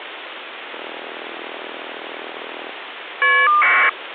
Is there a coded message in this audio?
Yes: caller ID data burst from 0.7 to 3.9 s, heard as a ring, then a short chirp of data, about 1200 baud, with phone line noise.